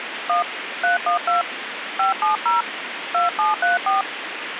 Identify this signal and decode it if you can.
DTMF, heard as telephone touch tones, dialled by hand, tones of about 140 ms, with phone line noise. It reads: 1 312 570 2734